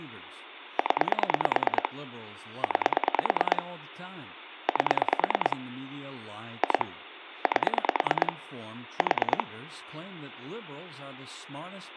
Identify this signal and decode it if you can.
Pulse dialling, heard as clicks on a phone line, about 9 pulses a second, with phone line noise and speech in English. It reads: 0 9 8 2 8 4